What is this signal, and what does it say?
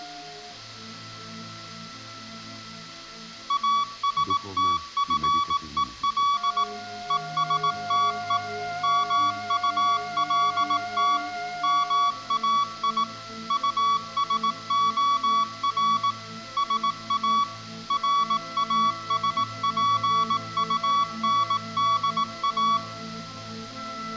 Morse code, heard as a keyed tone, machine-sent, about 18 wpm, 1140 Hz, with room echo. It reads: ASTFEL ESTE MULT MAI USOR SA RASPUNDA